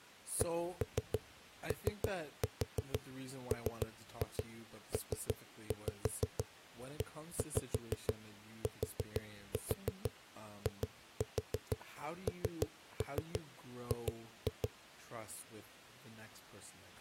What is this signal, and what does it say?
Tap code, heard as knocks on a wall, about 6 knocks a second, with speech in English. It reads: COMPETING